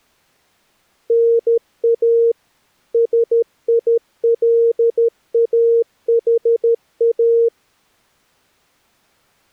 Morse code, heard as a keyed tone, machine-sent, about 13 wpm, 460 Hz. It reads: NA SILAHA